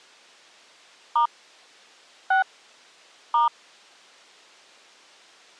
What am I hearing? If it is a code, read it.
DTMF, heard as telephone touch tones, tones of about 160 ms. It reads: * 6 *